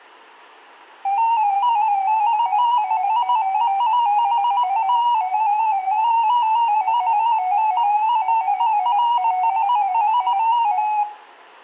Multi-tone FSK (Olivia or MFSK type), about 250 Hz wide, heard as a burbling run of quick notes, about 15.625 baud, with room echo.